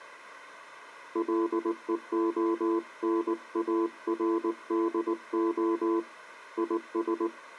Morse code, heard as a keyed tone, hand-sent with a paddle, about 19 wpm, 340 Hz. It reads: LEONARDO IS